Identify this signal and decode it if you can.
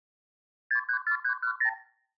Multi-frequency trunk signalling (R2, with the far end's replies), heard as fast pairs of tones, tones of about 90 ms, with room echo. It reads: 634310